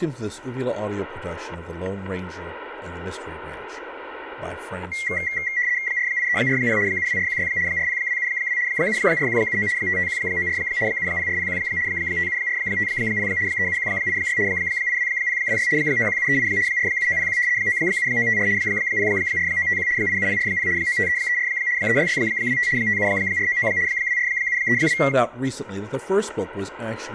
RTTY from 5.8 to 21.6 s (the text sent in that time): 48340 72416 40272 74179 55194 70401 57450 37186 82026 91738 47901 97954 04951 87040 95334